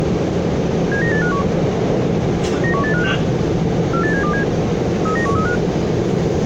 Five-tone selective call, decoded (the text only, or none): 79851 91856 48727 39135